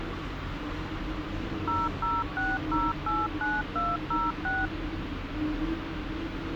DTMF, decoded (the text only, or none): 006089206